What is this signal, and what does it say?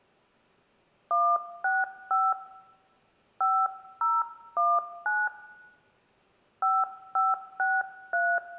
DTMF, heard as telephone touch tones, dialled by hand, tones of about 220 ms, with room echo. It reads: 165 5019 5563